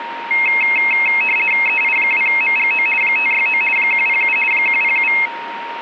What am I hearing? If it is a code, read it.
RTTY (50 baud, 450 Hz shift), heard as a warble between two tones, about 2350 Hz centre, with radio static and a steady whistle near 930 Hz. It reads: EI2MGO 569 107 107